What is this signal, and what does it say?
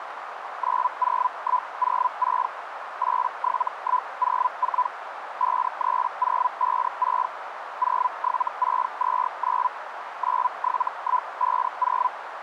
Hellschreiber (Feld-Hell, 122.5 baud), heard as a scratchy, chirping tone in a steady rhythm, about 1000 Hz, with radio static and a narrow filter. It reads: 90106 87104 53056 07629 97150